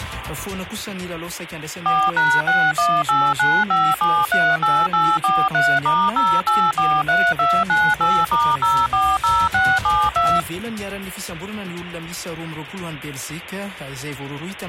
DTMF, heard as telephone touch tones, dialled by machine, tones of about 240 ms. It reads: 4#61895738843*0843298*040672